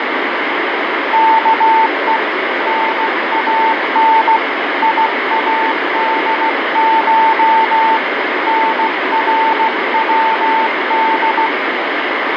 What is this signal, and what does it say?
Morse code (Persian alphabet), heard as a keyed tone, hand-sent with a paddle, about 16 wpm, 890 Hz, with heavy radio static and fading. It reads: که نان یادش نرود